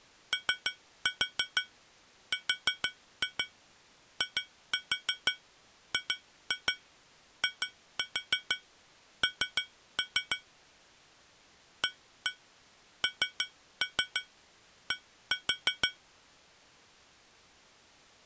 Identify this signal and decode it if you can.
Tap code, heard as taps on glass, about 6 knocks a second. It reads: ORIGIN AND